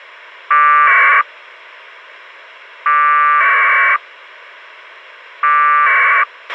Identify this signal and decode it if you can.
Packet radio (AX.25, as in APRS), 1200 baud, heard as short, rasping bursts, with a squelch burst at the end.